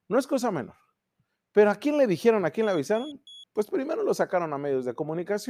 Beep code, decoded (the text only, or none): 3 short